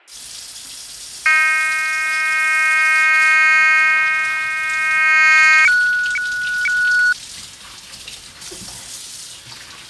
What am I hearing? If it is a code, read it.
Weather fax (radiofax), 120 lines a minute, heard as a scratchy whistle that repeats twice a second, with fading and kitchen noise.